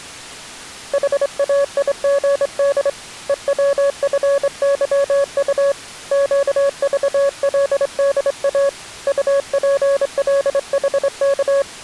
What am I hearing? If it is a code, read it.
Morse code, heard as a keyed tone, hand-sent with a straight key, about 25 wpm, 560 Hz. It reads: HAIGD EWFYU QVLDA UPLHK